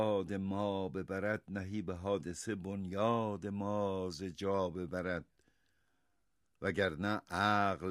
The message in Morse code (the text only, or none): none